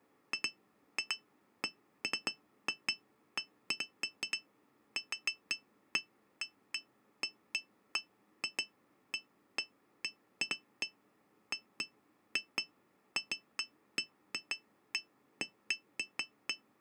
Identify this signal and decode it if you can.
Irregular taps on glass. There is no code.